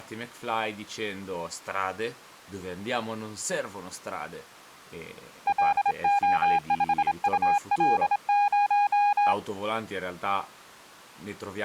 Morse code, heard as a keyed tone, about 26 wpm, 810 Hz, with speech in Italian. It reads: LO5UL0